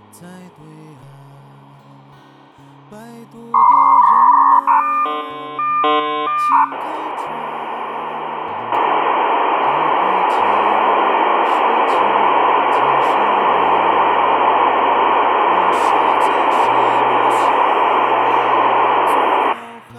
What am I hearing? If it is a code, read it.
Dial-up modem handshake (V.34 or later), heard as a whistle, warbles, then hiss.